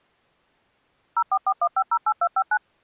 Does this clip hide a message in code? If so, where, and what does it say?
Yes: DTMF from 1.2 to 2.6 s, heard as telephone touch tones, dialled by machine, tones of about 60 ms. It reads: 0441508259